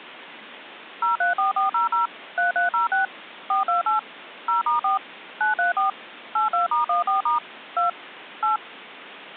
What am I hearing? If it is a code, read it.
DTMF, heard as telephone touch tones, dialled by machine, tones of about 130 ms. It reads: 034400 3306 428 0*4 934 82*14* 2 8